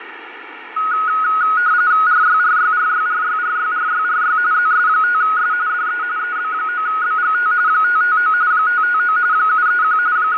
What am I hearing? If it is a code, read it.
RTTY (45.45 baud, 170 Hz shift), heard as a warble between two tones, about 1360 Hz centre, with radio static and fading. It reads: RYRYRYRYRYRYRY ZS5S DE EB9BGT 559 559 731 …